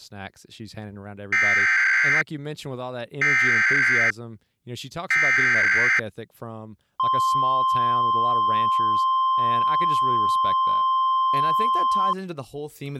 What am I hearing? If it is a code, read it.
Emergency Alert System (SAME) tones (header bursts, then the 1050 Hz attention tone), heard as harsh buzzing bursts, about 520.83 baud, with speech in English.